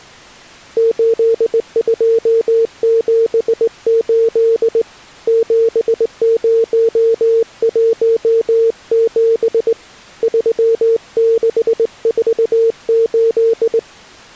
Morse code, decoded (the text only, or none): 8278 7017 3648